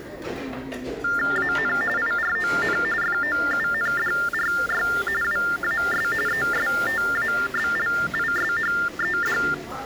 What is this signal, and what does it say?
TTY/TDD text telephone tones (45.45 baud Baudot), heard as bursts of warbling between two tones, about 400 Hz shift, 1600 Hz centre, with the noise of a crowd indoors. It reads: AN IRON FOUNDRY WAS ESTABLISHED